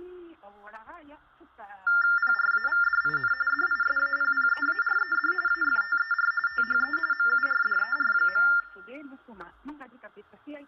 TTY/TDD text telephone tones (45.45 baud Baudot), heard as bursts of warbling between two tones, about 400 Hz shift, 1600 Hz centre, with room echo. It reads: PRAVDIN DISAPPEARED AFTER THE MURDER.